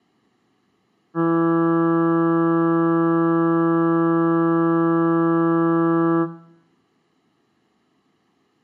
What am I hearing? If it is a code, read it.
Ship horn signal, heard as a ship's horn, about 170 Hz, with room echo. 1 long. At sea: a vessel nearing a blind bend, or under power and making way in fog.